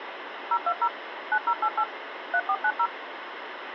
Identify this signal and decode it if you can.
DTMF, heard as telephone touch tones, dialled by machine, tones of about 60 ms, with phone line noise. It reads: 020 9088 3490